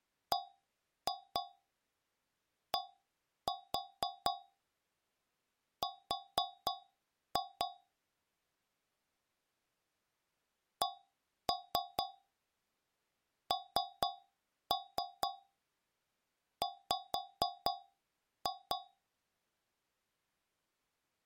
Tap code, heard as taps on a metal pipe, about 4 knocks a second. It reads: BDR CNW